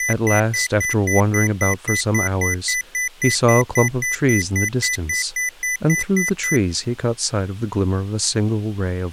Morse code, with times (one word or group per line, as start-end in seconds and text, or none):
none